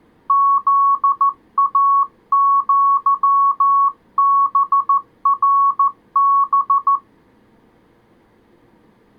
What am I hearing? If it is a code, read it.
Morse code (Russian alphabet), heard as a keyed tone, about 14 wpm, 1110 Hz. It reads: ЗАЪБРБ